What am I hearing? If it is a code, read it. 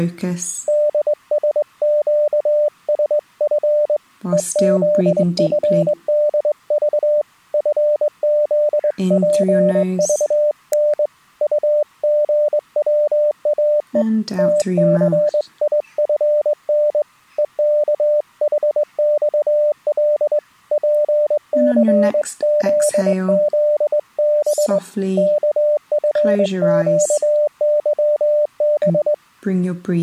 Morse code, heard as a keyed tone, hand-sent with a straight key, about 21 wpm, 600 Hz. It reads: DSQSF EZFDV FZPVN UGWAE TCIFN EKHXL PCZZB KFQYB